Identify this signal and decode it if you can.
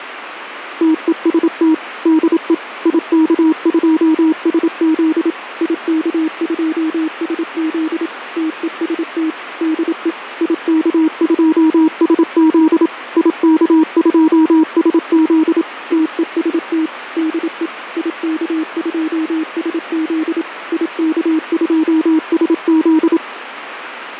Morse code, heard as a keyed tone, machine-sent, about 27 wpm, 310 Hz, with radio static and fading. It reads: TEST DE IK2SZ IK2SZ TEST DE IK2SZ IK2SZ TEST DE IK2SZ IK2SZ